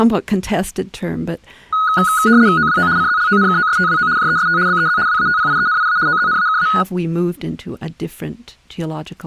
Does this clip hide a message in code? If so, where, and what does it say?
Yes: RTTY (75 baud, 170 Hz shift) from 1.7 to 6.8 s, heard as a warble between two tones, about 1360 Hz centre, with speech in English. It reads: OWO CZLONKOSTWO JEST BEZ WATPIENIA OZNAKA